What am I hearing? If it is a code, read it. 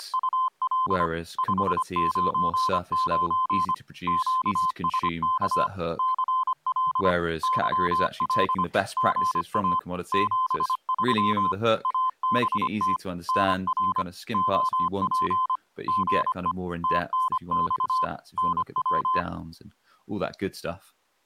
Morse code, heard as a keyed tone, machine-sent, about 25 wpm, 1030 Hz, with speech in English. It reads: … 599 QSK CL YL GA 73 ABT NR OP GE TNX NW